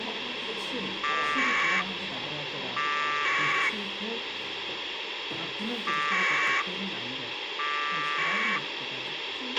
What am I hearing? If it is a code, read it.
Packet radio (AX.25, as in APRS), 1200 baud, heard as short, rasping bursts, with radio hiss, a squelch burst at the end and the noise of a crowd indoors.